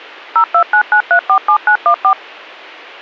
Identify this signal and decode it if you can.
DTMF, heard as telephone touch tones, dialled by machine, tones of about 80 ms. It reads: 0299347914